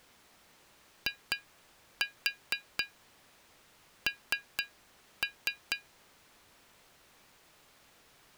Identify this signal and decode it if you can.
Tap code, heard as taps on glass, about 4 knocks a second. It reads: IN